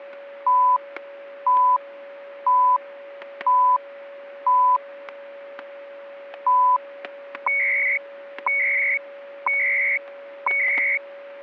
Radio time signal (CHU, Canada), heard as beeps and data bursts, one a second, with static crashes and a steady whistle near 560 Hz.